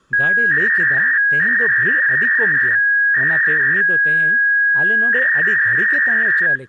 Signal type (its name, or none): 300-baud modem data